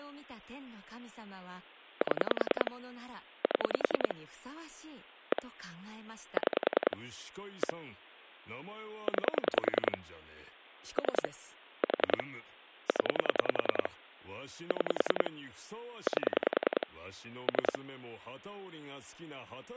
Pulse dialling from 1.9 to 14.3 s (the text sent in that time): 7 7 1 6 1 9 3 4 0